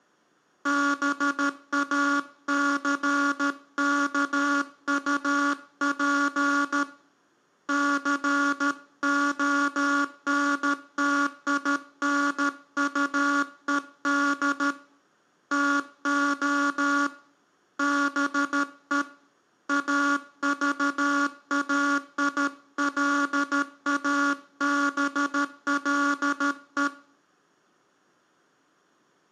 Morse code, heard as a buzzer, hand-sent with a paddle, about 13 wpm, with room echo. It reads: BACKUP CONTINUED TO BE AVAILABLE